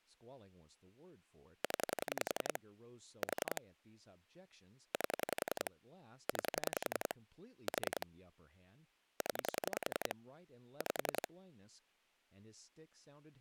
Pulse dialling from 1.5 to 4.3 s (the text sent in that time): 0 4